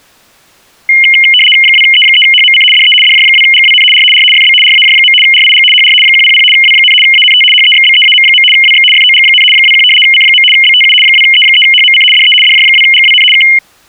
RTTY (75 baud, 850 Hz shift), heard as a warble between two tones, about 2550 Hz centre. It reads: 2E3HMC DE DJ2GWN R R FB RAJ. RIG HR 100 W, ANT HEXBEAM. WX FOG, 21 C. BTU 2E3HMC DE DJ2GWN K